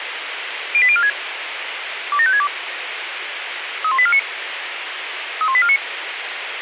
Five-tone selective call (ZVEI), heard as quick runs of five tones, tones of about 70 ms, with radio hiss and a squelch burst at the end. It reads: 08046 27562 31849 31849